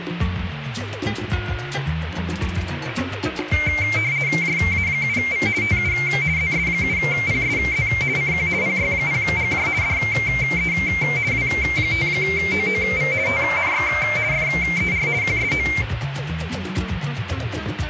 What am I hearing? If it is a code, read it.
RTTY (50 baud, 170 Hz shift), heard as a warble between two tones, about 2200 Hz centre, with radio static. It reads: JA7V TU ZS7PSZ CQ PY0GJ DE W5OOV TNX FER QSO